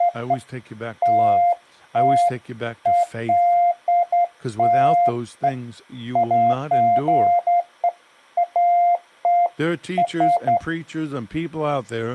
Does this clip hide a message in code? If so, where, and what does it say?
No, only beeps of irregular length, with speech in English.